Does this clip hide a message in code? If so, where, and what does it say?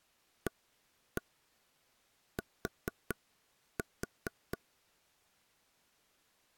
Yes: tap code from 0.5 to 4.6 s, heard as taps on a table, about 4 knocks a second. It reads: AT